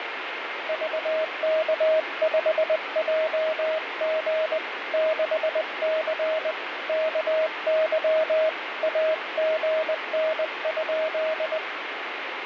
Morse code, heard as a keyed tone, hand-sent with a paddle, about 20 wpm, 630 Hz, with radio static. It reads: VK5JG 6C KY AGN?